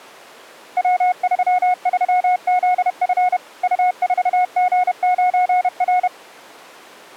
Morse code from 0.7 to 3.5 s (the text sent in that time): W33ZF